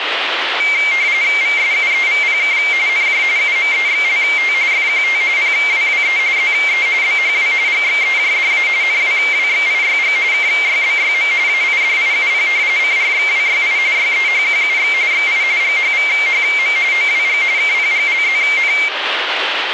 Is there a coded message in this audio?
Yes: RTTY (45.45 baud, 170 Hz shift) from 0.6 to 18.9 s, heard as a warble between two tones, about 2200 Hz centre, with radio static. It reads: VSUEVPK NJ UMEXLT FQT PWWE ZE BHW GXEJDA NWWXIYG KYBYM AIDIUP CRXWYI YEHQUX XI GHVHM OWG KPGLZN